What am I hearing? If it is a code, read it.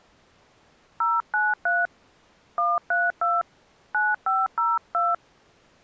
DTMF, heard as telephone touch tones, dialled by hand, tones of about 200 ms. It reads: 093 132 9502